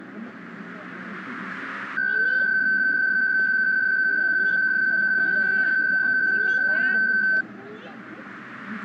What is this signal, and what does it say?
PSK63 (62.5 baud), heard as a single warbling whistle, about 1550 Hz, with the noise of a residential street.